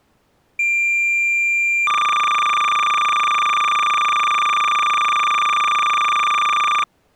Cassette data (Kansas City type), 300 baud, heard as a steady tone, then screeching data.